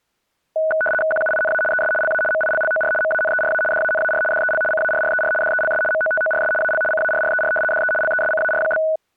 RTTY (75 baud, 850 Hz shift), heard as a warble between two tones, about 1060 Hz centre. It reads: QUINA ES LA MILLOR MANERA DANAR DEL CARRER DELS MOTORS AL CARRER DE LESCAR?